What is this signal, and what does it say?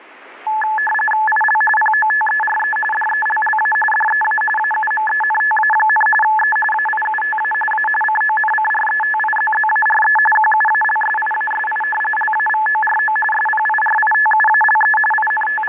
RTTY (45.45 baud, 850 Hz shift), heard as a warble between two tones, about 1290 Hz centre, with radio static. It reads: IL POTERE DELLA DEA AUMENTA, E AIUTA A CONCRETIZZARE QUALSIASI LAVORO SPIRITUALE …